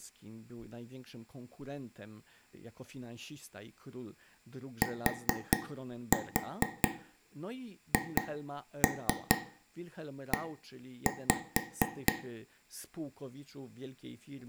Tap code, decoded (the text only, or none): THE